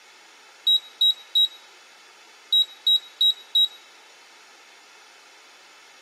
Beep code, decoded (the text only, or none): 3-4